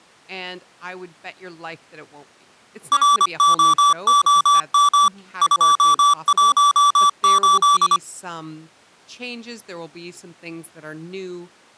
Morse code, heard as electronic beeps, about 25 wpm, 1160 Hz, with speech in English. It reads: ROOM 218